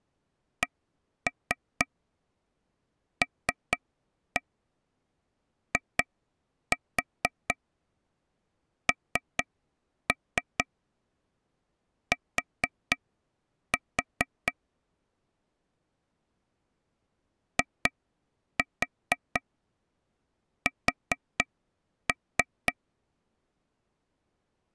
Tap code, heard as taps on a table, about 4 knocks a second. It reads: CLINT IS